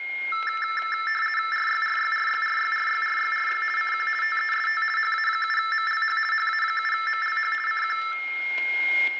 RTTY (50 baud, 450 Hz shift), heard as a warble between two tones, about 1550 Hz centre, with static crashes, a steady whistle near 2140 Hz and room echo. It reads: RYRYRYRYRYRYRY CQ TEST HA7MLH HA7MLH CQ